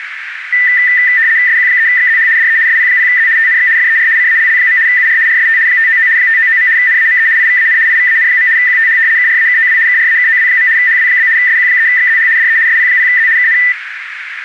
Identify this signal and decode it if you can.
RTTY (75 baud, 170 Hz shift), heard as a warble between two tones, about 1900 Hz centre, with radio static and a narrow filter. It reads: SQ3XZH DE SP0Z TNX FER CALL. UR RST 599 599. NAME IVAN IVAN. QTH KRAKOW KRAKOW. HW? SQ3XZH DE SP0Z KN